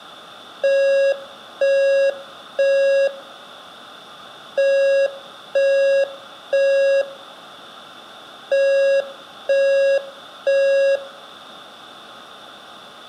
Alarm pattern, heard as an alarm's beeps, played three times, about 550 Hz, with room echo. Temporal three. Smoke or fire, evacuate.